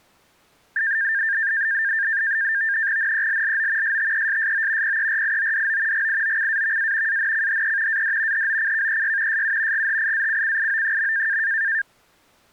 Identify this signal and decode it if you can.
NAVTEX (SITOR-B), 100 baud, 170 Hz shift, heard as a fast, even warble, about 1700 Hz centre. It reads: NELLO STESSO PERIODO GIOCAVA ANCHE AD HOCKEY SU GHIACCIO.